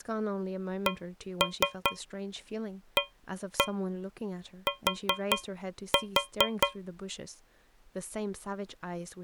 Tap code, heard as taps on a metal pipe, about 5 knocks a second, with speech in English. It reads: CAT